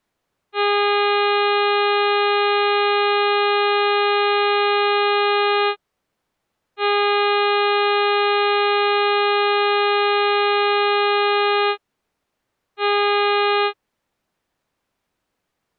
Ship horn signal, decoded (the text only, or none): 2 long, 1 short